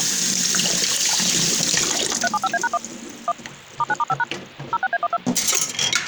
DTMF, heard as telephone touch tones, dialled by machine, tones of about 40 ms, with kitchen noise. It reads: 375A#1 1 *9*5# 06A12